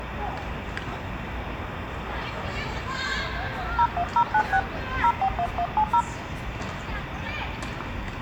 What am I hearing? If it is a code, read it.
DTMF, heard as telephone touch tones, dialled by hand, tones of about 70 ms, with radio hiss and the noise of a park. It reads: 01096 041170